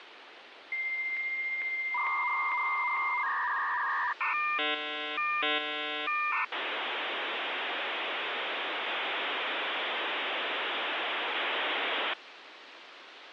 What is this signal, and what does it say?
Dial-up modem handshake (V.34 or later), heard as a whistle, warbles, then hiss, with phone line noise.